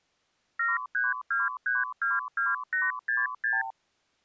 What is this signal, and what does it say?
Multi-frequency trunk signalling (R2, with the far end's replies), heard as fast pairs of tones, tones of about 180 ms. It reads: 732322866